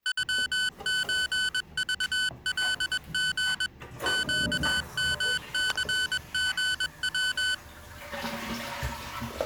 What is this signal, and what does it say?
Morse code (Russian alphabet), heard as electronic beeps, machine-sent, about 21 wpm, 1500 Hz, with the noise of a restroom. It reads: ЮЧЖЛГ ЩМЦГВ